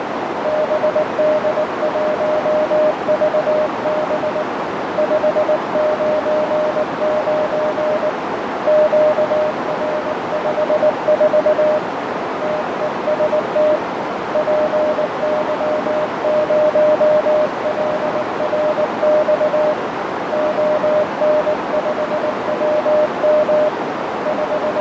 Morse code, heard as a keyed tone, hand-sent with a paddle, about 19 wpm, 610 Hz, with heavy radio static, fading and a narrow filter. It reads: BD1VB 599 QR54 TEST PY0LRX ON5WM …